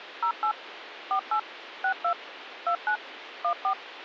DTMF, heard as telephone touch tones, dialled by machine, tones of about 90 ms, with phone line noise. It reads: 08 48 62 29 14